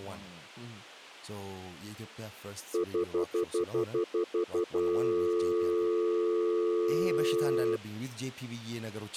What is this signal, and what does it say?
Telephone call progress tone (North American plan), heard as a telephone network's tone, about 350, 440 Hz, 0.1 s on and 0.1 s off, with speech in English. Stutter dial tone.